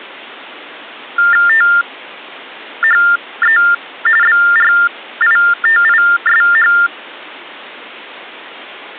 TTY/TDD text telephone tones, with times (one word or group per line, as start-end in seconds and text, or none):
1.5-3.6 THE
4.2-6.7 BRITISH